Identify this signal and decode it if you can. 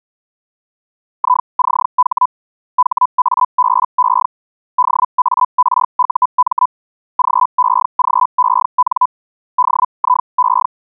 Hellschreiber (Feld-Hell, 122.5 baud), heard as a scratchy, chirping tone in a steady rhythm, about 1000 Hz. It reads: ICH HABE DARUM GEGEN DIE